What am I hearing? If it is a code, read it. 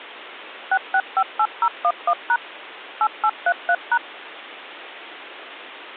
DTMF, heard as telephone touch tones, dialled by machine, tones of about 60 ms. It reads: 6658011# 8833#